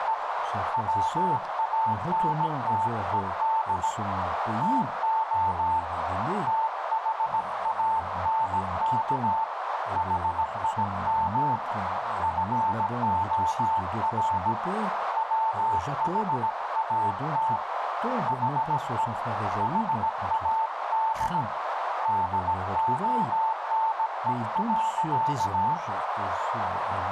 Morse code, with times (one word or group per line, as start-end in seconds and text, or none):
0.0-0.1 …
0.7-3.9 WANTED
4.6-5.8 TO
6.5-9.4 THANK
10.0-11.6 HIM
12.2-14.5 FOR
15.2-17.6 WHAT
18.3-19.1 HE
19.6-21.4 HAD
22.1-25.7 DONE.